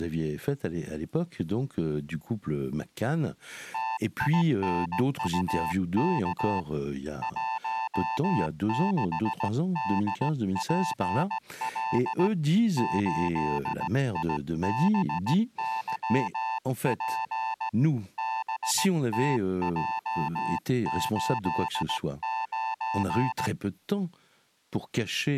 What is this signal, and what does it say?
Morse code, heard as a keyed tone, hand-sent with a straight key, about 17 wpm, 890 Hz, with speech in French. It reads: TINUK 16DPL 8IBYP BTJ89